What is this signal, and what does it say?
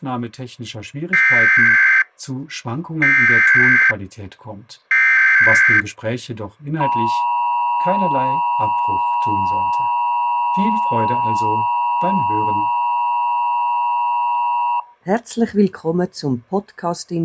Emergency Alert System (SAME) tones (header bursts, then the 853 and 960 Hz attention tone), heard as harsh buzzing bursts, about 520.83 baud.